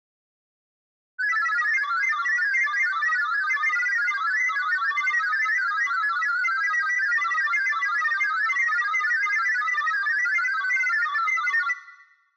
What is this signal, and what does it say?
Multi-tone FSK (Olivia or MFSK type), about 1000 Hz wide, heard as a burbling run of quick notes, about 31.25 baud.